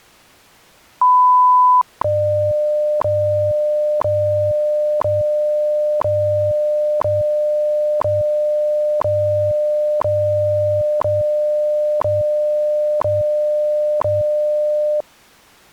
Radio time signal (WWV, Colorado), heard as ticks, one a second.